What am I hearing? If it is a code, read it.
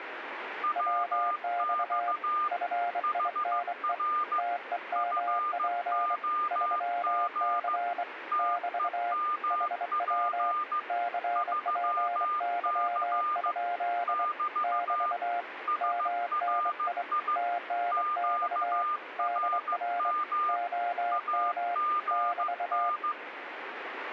Morse code, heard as two keyed tones, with radio static. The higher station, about 15 wpm, 1210 Hz: WX HR FOG TEMP 3C <BT> SRI QRM AGN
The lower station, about 24 wpm, 700 Hz: WX FINE TEMP 3C <BT> HW CPY? <BT> MNI TNX DR OM <BT>